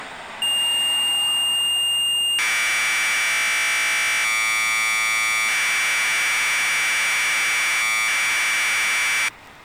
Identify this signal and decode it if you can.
Commodore tape loading (standard loader), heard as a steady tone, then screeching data, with street noise.